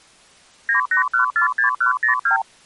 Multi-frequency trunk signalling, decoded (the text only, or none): 98146102